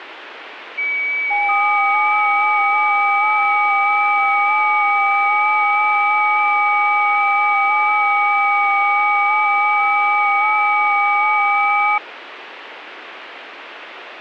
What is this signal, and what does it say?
FT8 (several signals at once), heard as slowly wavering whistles, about 6.25 baud, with radio static.